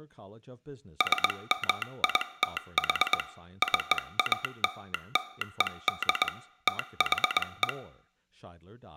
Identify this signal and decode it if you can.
Morse code (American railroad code), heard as a telegraph sounder, hand-sent with a straight key, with room echo and speech in English. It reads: SMITH CALLED THE